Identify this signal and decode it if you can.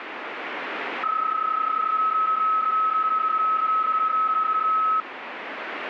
PSK31 (31.25 baud), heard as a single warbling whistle, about 1290 Hz, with radio static.